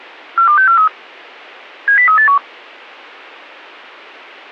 Five-tone selective call (CCIR), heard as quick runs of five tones, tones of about 100 ms. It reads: 42643 70381